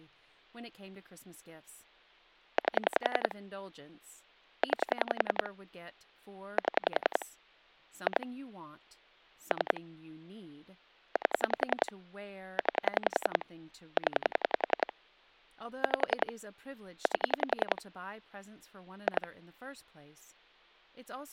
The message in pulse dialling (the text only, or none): 8 9 7 2 3 8 9 0 5 8 2